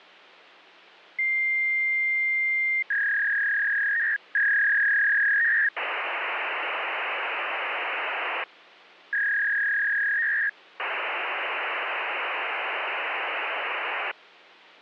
Fax machine handshake, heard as a long tone, a warble and hiss.